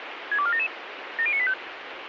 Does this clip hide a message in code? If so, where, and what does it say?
Yes: five-tone selective call (ZVEI) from 0.3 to 1.5 s, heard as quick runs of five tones, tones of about 70 ms, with radio hiss. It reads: 62477 70985